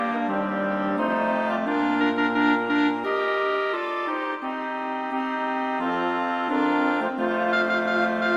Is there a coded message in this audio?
No.